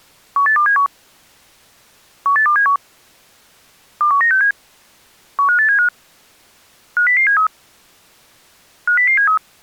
Five-tone selective call (CCIR), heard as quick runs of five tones, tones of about 100 ms. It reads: 18271 18271 21967 15875 50073 50073